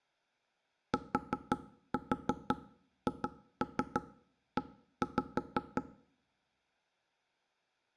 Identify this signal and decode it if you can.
Tap code, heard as knocks on wood, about 5 knocks a second, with room echo. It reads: THE